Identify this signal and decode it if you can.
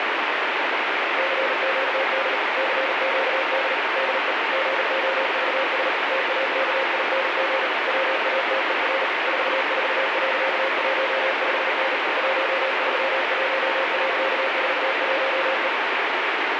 Morse code, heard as a keyed tone, machine-sent, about 38 wpm, 540 Hz, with heavy radio static. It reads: CQD CQD DE GOVS TAKING WATER 44.15N 131.41E